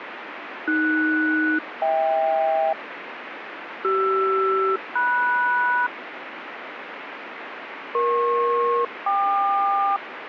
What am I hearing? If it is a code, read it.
Aircraft SELCAL, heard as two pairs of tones, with radio static. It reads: AS-HK CR-MS EP-KQ